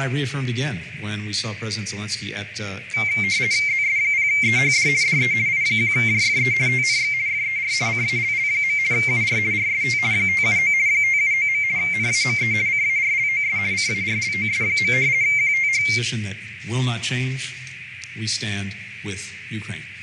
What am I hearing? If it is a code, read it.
RTTY (50 baud, 170 Hz shift), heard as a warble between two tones, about 2200 Hz centre, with radio static, fading and a narrow filter. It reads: ZS0EHD DE I1JFE TNX FER CALL. UR RST 579 579. NAME CARLOS CARLOS. QTH